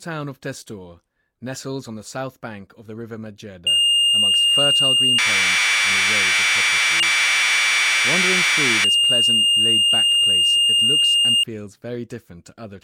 Commodore tape loading (standard loader), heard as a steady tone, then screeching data, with speech in English.